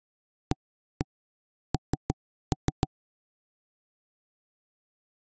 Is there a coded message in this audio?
Yes: tap code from 0.5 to 2.9 s, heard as knocks on wood, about 6 knocks a second. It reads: AN